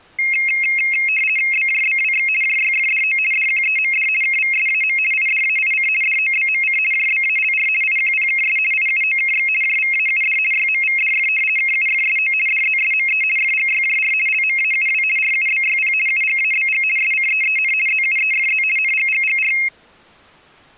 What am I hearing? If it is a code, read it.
RTTY (50 baud, 450 Hz shift), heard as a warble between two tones, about 2350 Hz centre. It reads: BJBWX JYFDO DQEMD KVSAM IDAIC DOBMC JBALR IQPKS IUOKX JVAUD YMVDF KUFSO DZSME FGYJR LMAUW RUBYP UGABG SCEEN ZUEFZ NGGGR